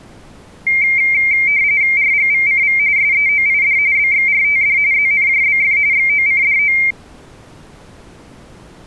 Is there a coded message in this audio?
Yes: RTTY (45.45 baud, 170 Hz shift) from 0.7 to 6.9 s, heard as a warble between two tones, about 2200 Hz centre. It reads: RGVCV SEOID BXRTD ZNJBF XOCDO